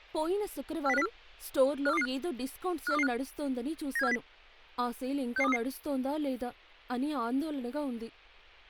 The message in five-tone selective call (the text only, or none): 40504 54225 54225 97470 66233